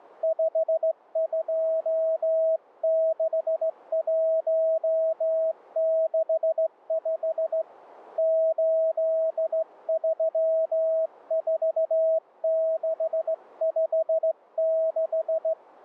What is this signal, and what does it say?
Morse code, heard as a keyed tone, hand-sent with a straight key, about 16 wpm, 640 Hz. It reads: 526165 834656